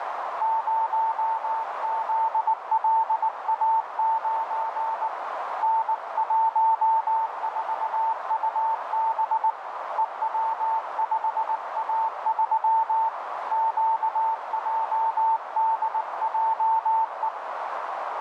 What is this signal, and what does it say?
Morse code, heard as a keyed tone, hand-sent with a paddle, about 19 wpm, 890 Hz, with heavy radio static and a narrow filter. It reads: 0ZLA9 N14UB EW5A3 QJDJE